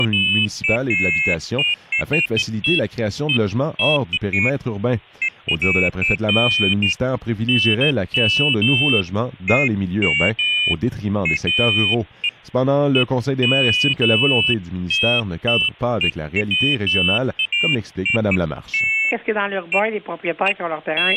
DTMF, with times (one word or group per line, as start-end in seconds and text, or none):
none